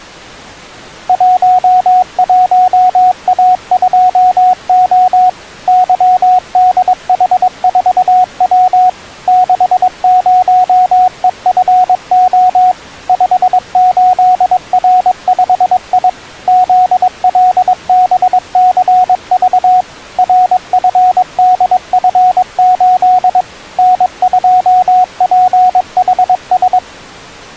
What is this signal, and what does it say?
Morse code, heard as a keyed tone, machine-sent, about 22 wpm, 730 Hz. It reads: 11A2O YDH4W 60EFO 58R5I ZLBCV RFDF8 N2PHS